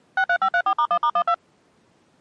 DTMF, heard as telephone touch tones, dialled by machine, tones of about 70 ms. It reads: 63534*1*12